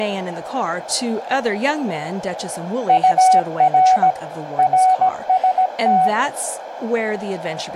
Morse code, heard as a keyed tone, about 17 wpm, 750 Hz, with radio static, a narrow filter and speech in English. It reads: UR RST